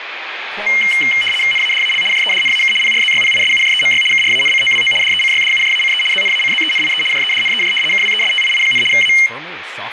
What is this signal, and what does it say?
RTTY (75 baud, 850 Hz shift), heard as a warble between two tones, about 2550 Hz centre, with radio static and speech in English. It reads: NADAL JEDNAK PRZYPISUJEMY KRANCOWO DECYDUJACE ZNACZENIE JEDNEJ KWESTII, A